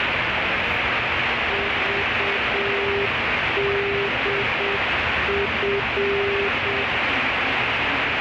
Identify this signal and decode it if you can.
Morse code, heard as a keyed tone, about 7 wpm, 400 Hz, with heavy radio static and the noise inside a subway train. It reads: VDF